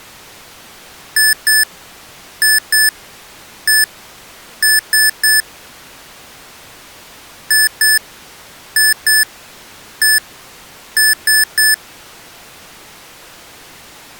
Beep code, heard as beeps from a small speaker, played twice, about 1750 Hz. 2-2-1-3.